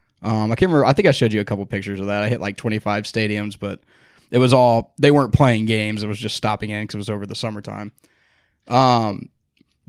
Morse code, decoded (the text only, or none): none